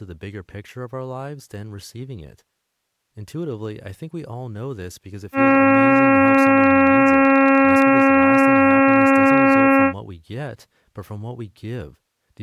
Ship horn signal, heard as a ship's horn, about 270 Hz, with speech in English. 1 long. At sea: a vessel nearing a blind bend, or under power and making way in fog.